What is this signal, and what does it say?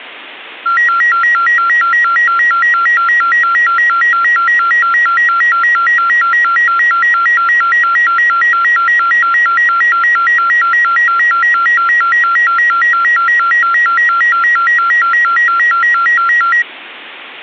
A tone that alternates evenly between two pitches. There is no code.